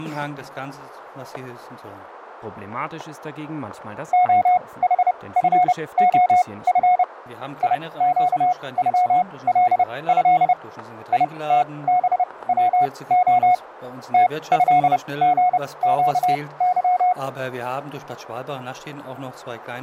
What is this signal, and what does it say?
Morse code (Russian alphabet), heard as a keyed tone, machine-sent, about 30 wpm, spaced as for 21 wpm, 720 Hz, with static crashes. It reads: ОХФОФ ИЩЮЛЭ ИТБВО ТЭГЩЫ